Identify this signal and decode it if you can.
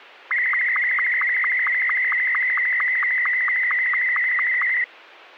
SSTV (slow-scan television), Martin M2, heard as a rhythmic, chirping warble.